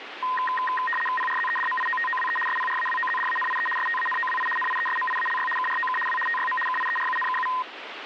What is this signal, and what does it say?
RTTY (75 baud, 850 Hz shift), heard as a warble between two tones, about 1440 Hz centre, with radio static. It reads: PRZEDMIOTOWE SPRAWOZDANIE STANOWI NIESMIALY KROK W TYM KIERUNKU